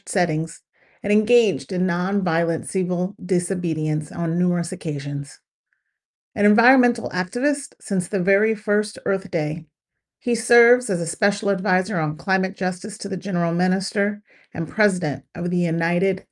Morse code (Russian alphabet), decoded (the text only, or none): none